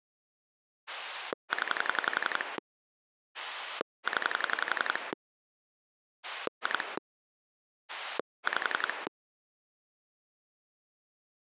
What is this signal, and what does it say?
Pulse dialling, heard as a rotary dial, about 11 pulses a second. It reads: 0 0 2 5